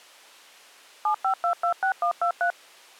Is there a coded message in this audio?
Yes: DTMF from 1.1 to 2.5 s, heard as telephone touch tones, dialled by machine, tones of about 90 ms. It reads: 75226123